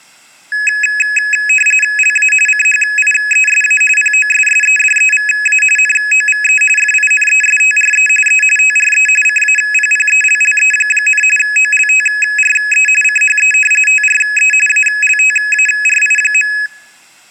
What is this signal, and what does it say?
RTTY (45.45 baud, 850 Hz shift), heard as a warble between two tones, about 2100 Hz centre. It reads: LA CHIESA POSSEDEVA NOVE FINESTRE E TRE CAPPELLE, OLTRE CHE TRE ALTARI.